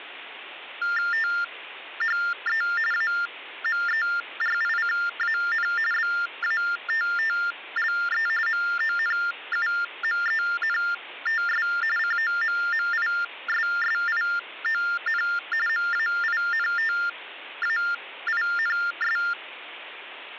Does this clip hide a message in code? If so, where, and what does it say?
Yes: TTY/TDD text telephone tones (45.45 baud Baudot) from 0.8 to 19.3 s, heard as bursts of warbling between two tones, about 400 Hz shift, 1600 Hz centre, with phone line noise. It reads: THE AMERICAN BATTLE MONUMENTS COMMISSION MAINTAINS